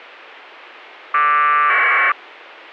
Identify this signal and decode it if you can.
Packet radio (AX.25, as in APRS), 1200 baud, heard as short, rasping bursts.